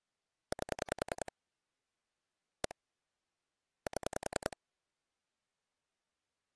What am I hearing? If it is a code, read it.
Pulse dialling, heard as clicks on a phone line, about 10 pulses a second. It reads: 8 1 7